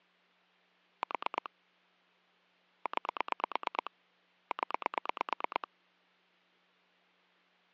Pulse dialling, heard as clicks on a phone line, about 9 pulses a second, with hum. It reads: 4 9 0